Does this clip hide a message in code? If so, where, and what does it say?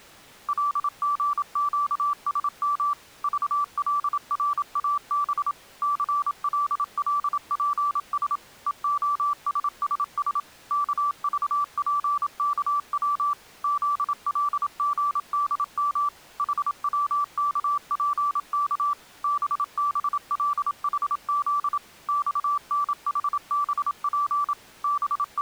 Yes: Morse code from 0.4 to 25.4 s, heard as a keyed tone, machine-sent, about 27 wpm, 1160 Hz. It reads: LGQSM VLRAB CLLPS EOSSS KVPKW ZLGDM HWKPK BBLHZ XNHBP …